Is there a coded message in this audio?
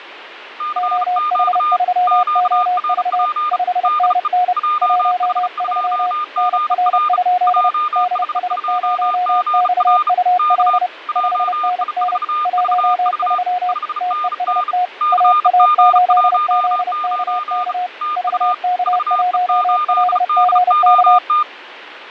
Yes: Morse code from 0.5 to 21.5 s, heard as two keyed tones, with radio static and fading. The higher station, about 35 wpm, 1210 Hz: CQ QRP DE JH2GR JH2GR K JI4VV 5NN CG19 TU VE8DOT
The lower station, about 30 wpm, 720 Hz: OH3OV 5NN 13 NR? DS0XUL 5NN 13 TEST AA8ZKK VK1LGK